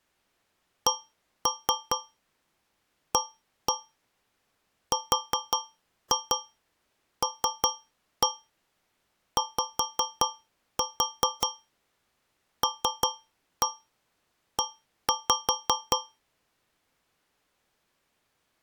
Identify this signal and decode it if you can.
Tap code, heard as taps on a metal pipe, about 5 knocks a second. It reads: CARLYLE